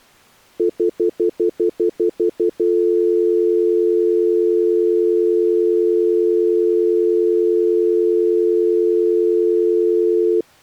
Telephone call progress tone (North American plan), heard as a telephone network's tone, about 350, 440 Hz, 0.1 s on and 0.1 s off. Stutter dial tone.